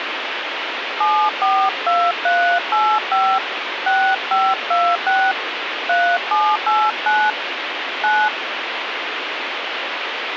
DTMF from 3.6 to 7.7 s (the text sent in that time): 6526 3789